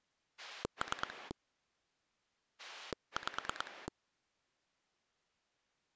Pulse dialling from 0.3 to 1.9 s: 3

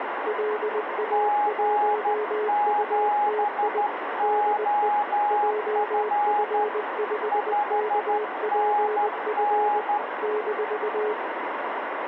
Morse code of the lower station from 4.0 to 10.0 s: DE JF5KPF

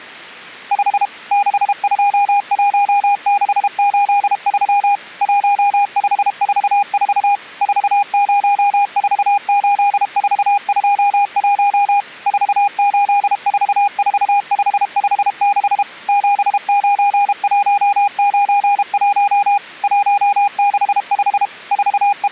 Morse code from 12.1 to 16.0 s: 4844556

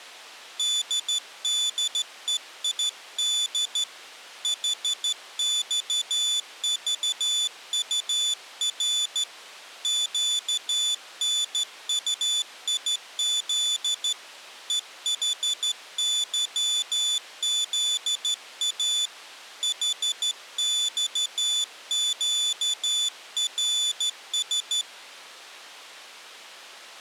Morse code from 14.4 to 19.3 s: EHYZA

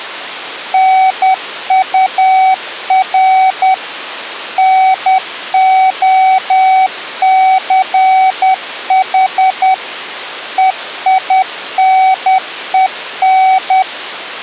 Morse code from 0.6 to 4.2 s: NUR

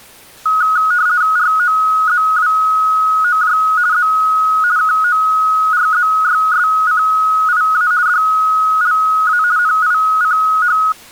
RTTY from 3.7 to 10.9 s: Z KORZYSCIA DLA NICH

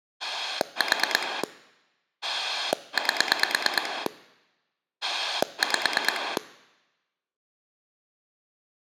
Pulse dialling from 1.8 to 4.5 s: 8

